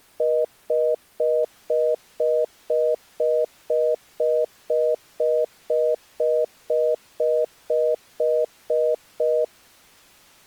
Telephone call progress tone (North American plan), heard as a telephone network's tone, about 480, 620 Hz, 0.25 s on and 0.25 s off. Congestion tone.